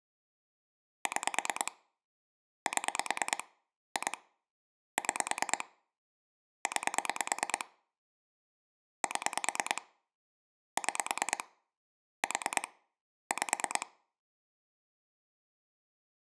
Pulse dialling, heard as clicks on a phone line, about 9 pulses a second. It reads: 6 7 2 6 9 7 6 4 5